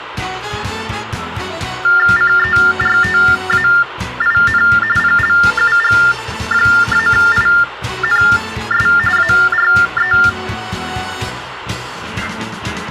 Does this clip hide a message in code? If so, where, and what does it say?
Yes: TTY/TDD text telephone tones (45.45 baud Baudot) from 1.8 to 10.3 s, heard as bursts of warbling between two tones, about 400 Hz shift, 1600 Hz centre, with phone line noise. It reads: CERTAIN PLUG-INS ARE